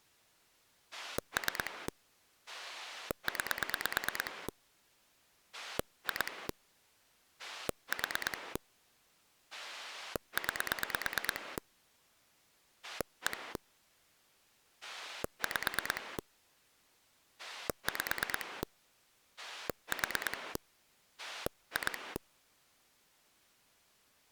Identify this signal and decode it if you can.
Pulse dialling, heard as a rotary dial, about 9 pulses a second. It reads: 3 9 2 4 9 1 5 5 4 2